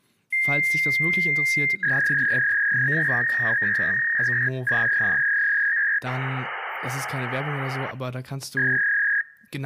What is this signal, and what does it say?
Fax machine handshake, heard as a long tone, a warble and hiss, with speech in German.